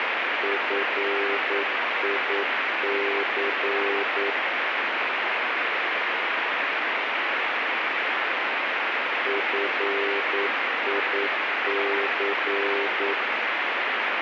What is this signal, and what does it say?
Morse code, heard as a keyed tone, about 9 wpm, 400 Hz, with heavy radio static. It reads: FIC FIC